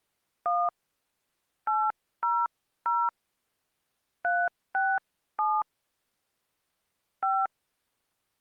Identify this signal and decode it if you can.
DTMF, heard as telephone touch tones, dialled by hand, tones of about 230 ms. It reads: 1 800 367 5